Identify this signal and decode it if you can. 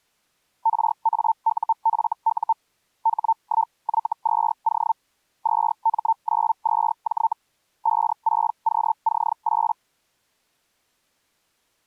Hellschreiber (Feld-Hell, 122.5 baud), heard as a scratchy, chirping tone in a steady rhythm, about 900 Hz. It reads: RAUFU H1Y2O 2M92J 56QC8